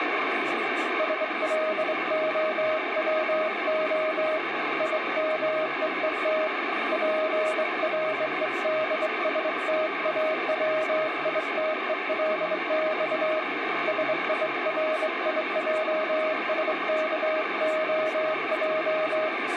Morse code (Russian alphabet), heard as a keyed tone, hand-sent with a straight key, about 24 wpm, 630 Hz, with radio static and speech in Portuguese. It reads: СЛОВО ИМЕЕТ ПРЕДСТАВИТЕЛЬ СИРИЙСКОЙ